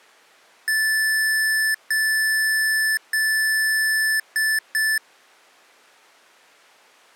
Beep code, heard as beeps from a small speaker, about 1750 Hz. 3 long, 2 short.